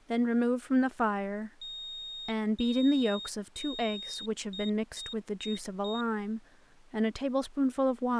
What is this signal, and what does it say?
Beep code, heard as a piezo beeper, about 3700 Hz, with speech in English. 3 long, 4 short.